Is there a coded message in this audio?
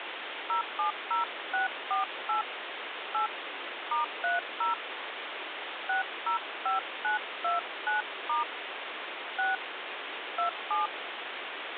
Yes: DTMF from 0.5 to 10.9 s, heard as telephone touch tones, dialled by hand, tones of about 130 ms, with phone line noise. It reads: 070648 8 *30 605929* 6 27